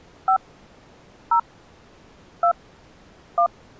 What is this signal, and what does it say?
DTMF, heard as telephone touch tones, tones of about 90 ms. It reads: 5 0 2 1